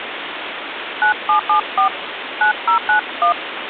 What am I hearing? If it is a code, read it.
DTMF, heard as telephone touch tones, dialled by hand, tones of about 110 ms, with phone line noise. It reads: 9774 9091